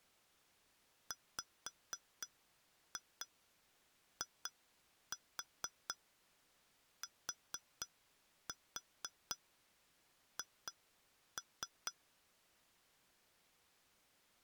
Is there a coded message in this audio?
Yes: tap code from 1.1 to 12.0 s, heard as taps on glass, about 4 knocks a second. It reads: WITH